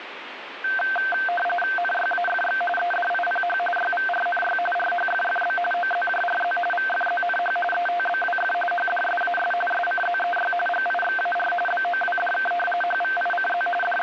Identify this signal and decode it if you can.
RTTY (45.45 baud, 850 Hz shift), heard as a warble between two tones, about 1130 Hz centre, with radio static. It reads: NYAFX EDIPH YVRNY RHFFB OZJRZ VFZNH ETBWF HDSAS SCZEY GIXAR BOWDK HVICZ …